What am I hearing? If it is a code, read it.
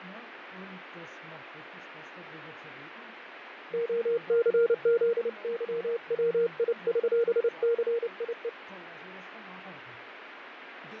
Morse code (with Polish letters), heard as a keyed tone, hand-sent with a paddle, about 29 wpm, 470 Hz, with radio static and fading. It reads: OCZYWIŚCIE